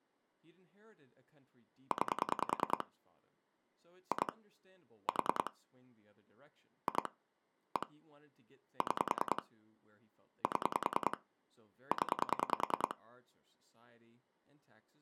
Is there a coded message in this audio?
Yes: pulse dialling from 1.9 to 12.9 s, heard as clicks on a phone line, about 10 pulses a second, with speech in English. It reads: 9 2 4 2 1 6 7 0